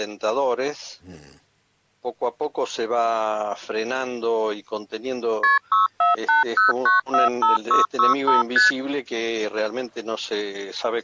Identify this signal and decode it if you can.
Multi-frequency trunk signalling (R1, as on North American trunks), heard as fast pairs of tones, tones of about 150 ms. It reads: KP 6480945665 ST